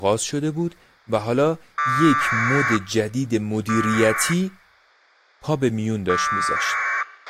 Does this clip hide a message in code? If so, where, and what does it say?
Yes: packet radio (AX.25, as in APRS), 1200 baud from 1.8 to 7.0 s, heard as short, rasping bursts, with a squelch burst at the end and speech in Persian.